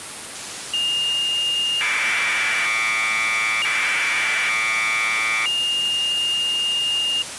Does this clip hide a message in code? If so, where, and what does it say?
Yes: Commodore tape loading (standard loader) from 0.7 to 7.2 s, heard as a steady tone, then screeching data, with tape hiss.